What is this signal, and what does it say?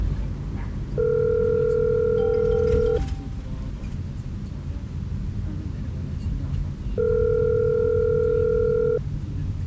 Telephone call progress tone (North American plan), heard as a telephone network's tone, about 440, 480 Hz, 2 s on and 4 s off, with the noise inside a car. Ringback tone.